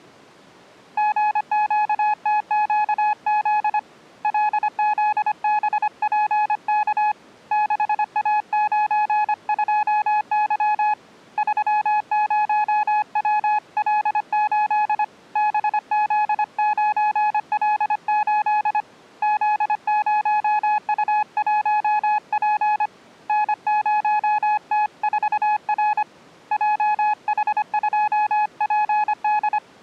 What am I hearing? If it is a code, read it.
Morse code, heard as a keyed tone, hand-sent with a paddle, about 25 wpm, 840 Hz. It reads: GQTQZ LZBPK 6A92Y 30WL8 BZ9L8 Z0U1P N0T4R JH2PD